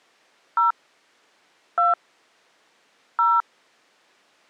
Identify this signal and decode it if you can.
DTMF, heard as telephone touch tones, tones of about 180 ms. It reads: 0 2 0